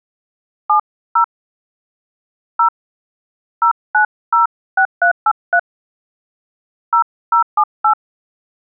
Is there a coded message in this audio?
Yes: DTMF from 0.7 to 7.9 s, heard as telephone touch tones, dialled by hand, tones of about 90 ms. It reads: 70 0 0906383 0078